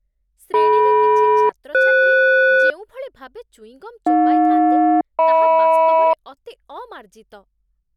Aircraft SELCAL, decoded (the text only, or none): DM-FS AJ-HM